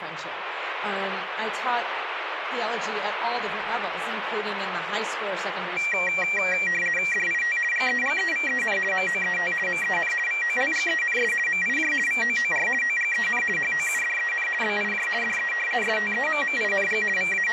RTTY (50 baud, 450 Hz shift), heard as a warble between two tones, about 2150 Hz centre, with radio static. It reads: DIT GEGEVEN MOET MEN VOLGENS MIJ VOOR OGEN HOUDEN BIJ DE STEMMING …